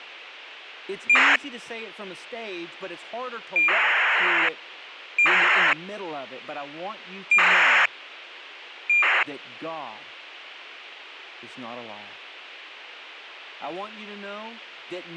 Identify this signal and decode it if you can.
ACARS aircraft data, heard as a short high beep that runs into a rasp, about 2400 baud, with radio hiss and speech in English.